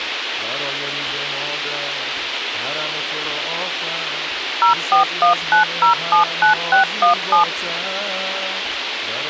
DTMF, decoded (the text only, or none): 0419079617